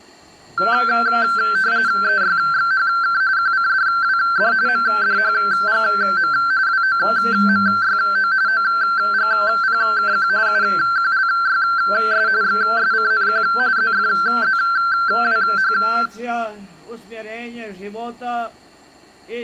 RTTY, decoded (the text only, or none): EYXHK QCDWD MDHGM WOMYO OGPKQ UQLYS XSCNQ ZFZWH